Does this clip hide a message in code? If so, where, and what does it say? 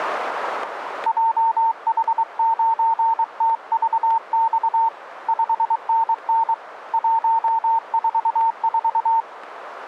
Yes: Morse code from 1.0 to 9.3 s, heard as a keyed tone, hand-sent with a paddle, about 23 wpm, 910 Hz, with radio static. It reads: JH9TVX 5NN 144